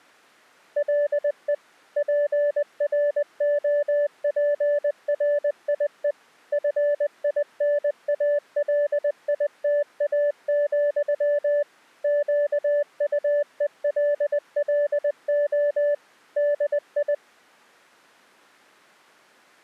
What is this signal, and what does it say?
Morse code, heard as a keyed tone, machine-sent, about 20 wpm, 580 Hz. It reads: LE PROPRIE FINALITA, QUELLO DI